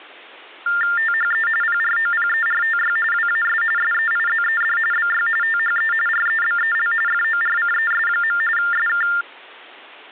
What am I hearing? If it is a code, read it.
TTY/TDD text telephone tones (45.45 baud Baudot), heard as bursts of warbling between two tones, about 400 Hz shift, 1600 Hz centre. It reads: THE PROPERTY WAS SEIZED BY THE REBEL FORCES. SK